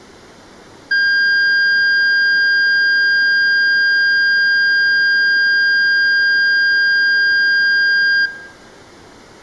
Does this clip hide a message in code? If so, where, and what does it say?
No, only a steady tone, with room echo.